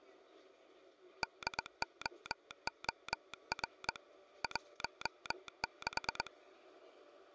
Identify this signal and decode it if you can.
Morse code, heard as a telegraph sounder, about 22 wpm, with the noise inside a bus. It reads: DOOR 16